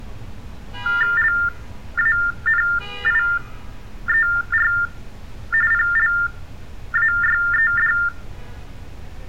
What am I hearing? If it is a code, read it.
TTY/TDD text telephone tones (45.45 baud Baudot), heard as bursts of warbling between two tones, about 400 Hz shift, 1600 Hz centre, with room echo and street noise. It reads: LANIER PLAYED